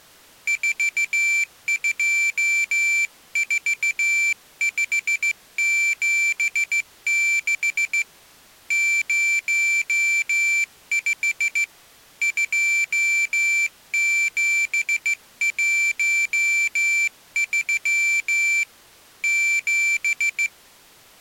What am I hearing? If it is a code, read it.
Morse code, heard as a high beeper, hand-sent with a straight key, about 15 wpm, 2350 Hz. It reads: 424576 05 2713 7